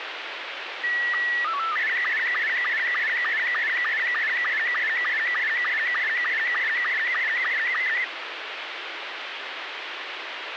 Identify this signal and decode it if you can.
SSTV (slow-scan television), Robot 72, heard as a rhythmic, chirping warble, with radio hiss and a squelch burst at the end.